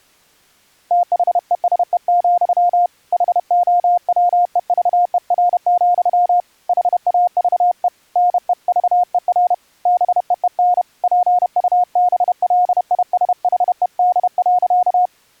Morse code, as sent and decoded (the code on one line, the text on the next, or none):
- .... . ... . --..-- / .... --- .-- . ...- . .-. --..-- / .... .- ...- . / -. . ...- . .-. / -... . . -. / .--. ..- -... .-.. .. ... .... . -.. .-.-.-
THESE, HOWEVER, HAVE NEVER BEEN PUBLISHED.